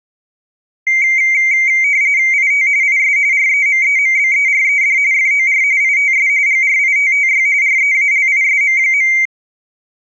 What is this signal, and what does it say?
RTTY (45.45 baud, 170 Hz shift), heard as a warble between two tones, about 2200 Hz centre. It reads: IT IS REMEMBERED FOR ITS GRITTY REALISM.